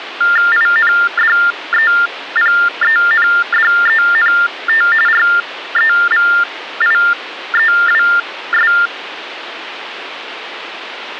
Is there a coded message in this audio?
Yes: TTY/TDD text telephone tones (45.45 baud Baudot) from 0.2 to 8.9 s, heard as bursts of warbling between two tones, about 400 Hz shift, 1600 Hz centre, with phone line noise. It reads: INDEPENDENT REVIEWS